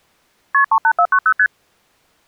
Multi-frequency trunk signalling (R1, as on North American trunks), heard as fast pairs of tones, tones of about 70 ms. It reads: KP 38490 ST